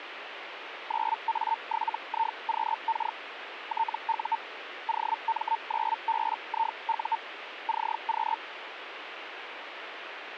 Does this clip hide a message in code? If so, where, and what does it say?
Yes: Hellschreiber (Feld-Hell, 122.5 baud) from 0.9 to 8.4 s, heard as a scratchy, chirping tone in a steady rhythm, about 900 Hz, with radio static. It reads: 9A7IQK TU OM9BIU CQ